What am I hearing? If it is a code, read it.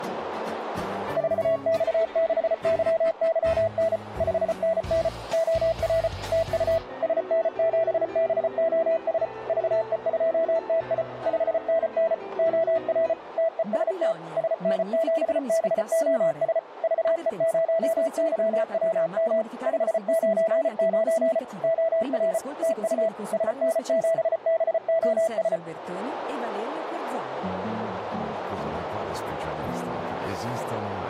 Morse code, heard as a keyed tone, machine-sent, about 34 wpm, 660 Hz, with radio static. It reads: 4X6YYN 5NN OR TU SN7BOS VE2TI 5NN OR TEST SN7BOS VE0YWM 599 OR TU SN7BOS